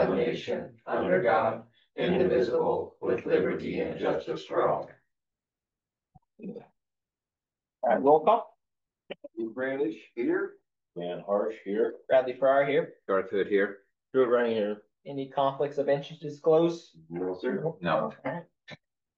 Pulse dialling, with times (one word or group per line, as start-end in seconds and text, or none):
none